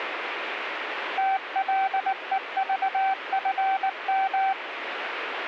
Morse code, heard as a keyed tone, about 19 wpm, 770 Hz, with radio static. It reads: TLEVFM